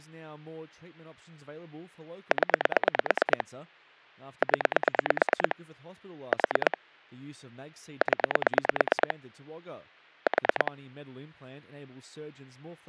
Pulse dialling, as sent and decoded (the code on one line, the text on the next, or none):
10 / 10 / 4 / 10 / 4
0 0 4 0 4